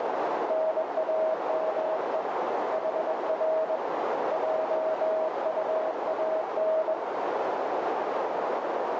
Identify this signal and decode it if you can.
Morse code, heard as a keyed tone, hand-sent with a bug key, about 21 wpm, 640 Hz, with heavy radio static and a narrow filter. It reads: NAME HR JUAN